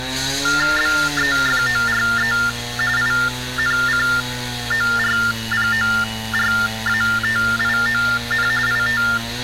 TTY/TDD text telephone tones (45.45 baud Baudot), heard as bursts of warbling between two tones, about 400 Hz shift, 1600 Hz centre, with street noise. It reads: BEFORE INCORPORATION IT